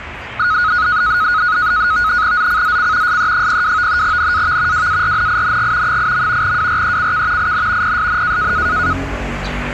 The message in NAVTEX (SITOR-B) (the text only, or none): ZCZC SE02 NAV WARNING 8. WRECK IN PSN